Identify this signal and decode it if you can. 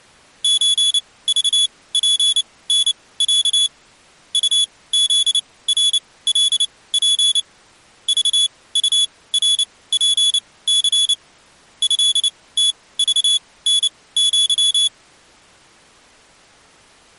Morse code (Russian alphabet), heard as a high beeper, machine-sent, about 29 wpm, spaced as for 19 wpm, 3400 Hz. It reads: ЧЖПНЯ УЗРЛП ЖУРПЦ ЭТЖНЪ